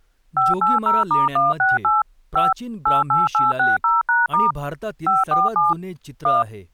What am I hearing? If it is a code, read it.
DTMF, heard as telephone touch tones, dialled by machine, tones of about 170 ms, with speech in Marathi. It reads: 580*168 5 88860#* 547 1